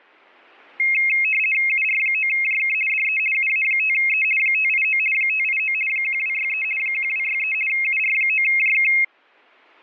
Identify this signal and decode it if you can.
RTTY (50 baud, 450 Hz shift), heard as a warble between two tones, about 2350 Hz centre. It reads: UR9JK DE UA5E 589 589 1263 1263 UR9JK